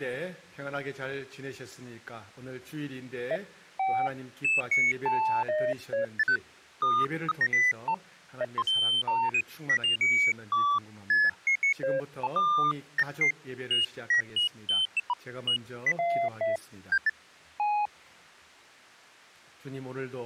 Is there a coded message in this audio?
No, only electronic bleeps of random pitch and length.